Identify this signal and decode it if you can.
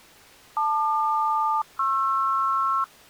Aircraft SELCAL, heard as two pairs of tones. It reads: LQ-PR